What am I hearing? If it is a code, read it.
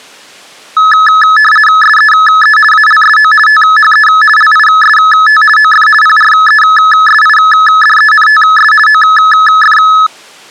RTTY (50 baud, 450 Hz shift), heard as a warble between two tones, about 1500 Hz centre. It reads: SEE ALSO THE LIST OF PRESIDENTS OF